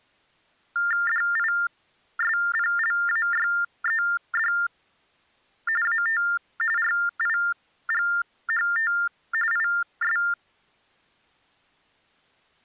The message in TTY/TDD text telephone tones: DISPLAYED AT RIGHT IS

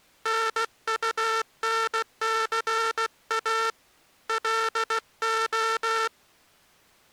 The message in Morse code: NUNCA LO

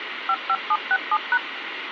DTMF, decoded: 55767#

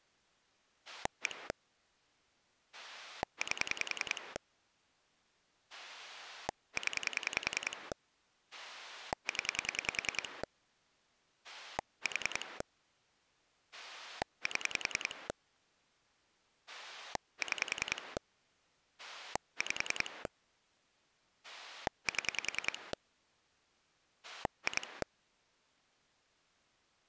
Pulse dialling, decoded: 1 8 0 0 4 7 6 5 7 2

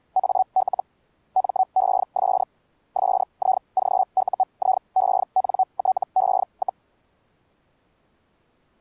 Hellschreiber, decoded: AL MES SIGUIENTE,

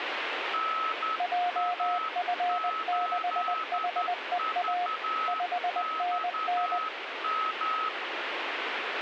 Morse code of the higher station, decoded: NA8VXM

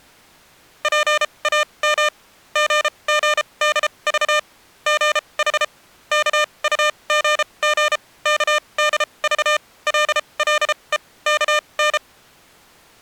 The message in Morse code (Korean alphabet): 좀 쓸 수 있을까요

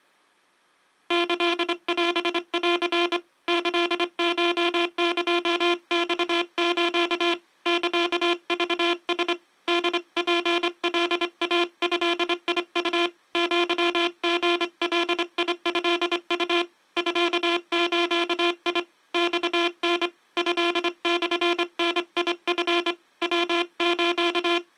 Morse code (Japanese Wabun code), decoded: キオン キコエマス サクラ ホツカイドウ アリガトウ ミズ マタ トモダチ …

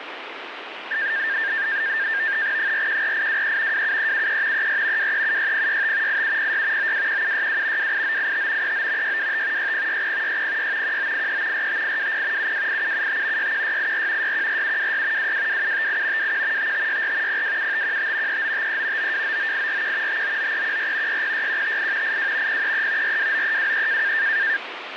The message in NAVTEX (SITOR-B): 414823 27373 34 2376065 8706 921762 28985 39 625 6060 606 1983 45820 728775 61684 614726 222758 21 5564 027515 3953 9299841 599314 606158 82 033 429323

